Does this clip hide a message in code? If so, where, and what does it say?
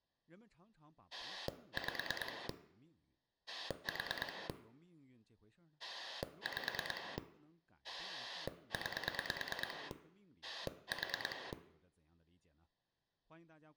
Yes: pulse dialling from 1.1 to 11.5 s, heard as a rotary dial, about 9 pulses a second, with speech in Chinese. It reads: 5 4 5 9 4